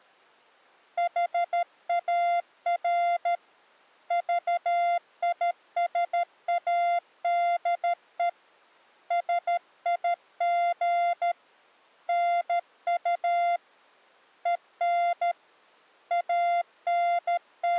Morse code, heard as a keyed tone, hand-sent with a paddle, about 13 wpm, 700 Hz. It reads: HAR VISADE SIG NU EN …